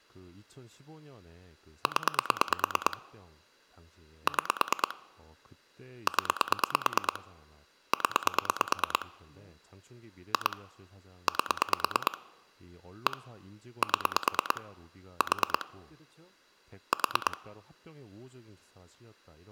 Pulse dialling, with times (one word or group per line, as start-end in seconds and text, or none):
1.9-3.0 0
4.3-5.0 6
6.1-7.2 0
7.9-9.1 0
10.3-10.6 2
11.3-12.2 8
13.1-13.2 1
13.8-14.6 7
15.2-15.7 4
16.9-17.4 4